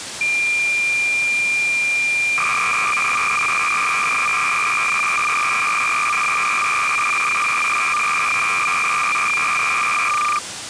Cassette data (Kansas City type), 300 baud, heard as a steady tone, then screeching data, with tape hiss.